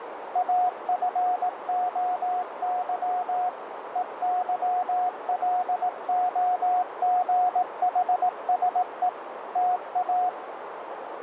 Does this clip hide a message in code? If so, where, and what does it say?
Yes: Morse code (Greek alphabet) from 0.3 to 10.4 s, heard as a keyed tone, machine-sent, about 18 wpm, 720 Hz, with radio static and a narrow filter. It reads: ΑΦΟΥ ΕΥΛΟΓΗΣΕ ΤΑ